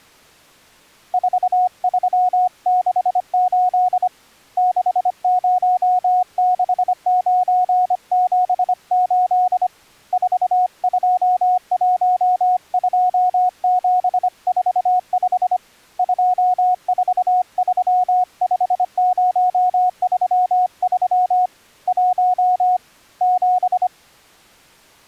Morse code, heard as a keyed tone, hand-sent with a bug key, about 25 wpm, 730 Hz. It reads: 4368 606978 4212745 2435033 1 7